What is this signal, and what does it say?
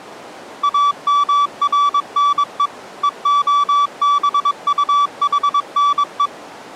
Morse code (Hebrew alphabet), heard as a keyed tone, machine-sent, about 22 wpm, 1150 Hz. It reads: אמרנו והבטחנו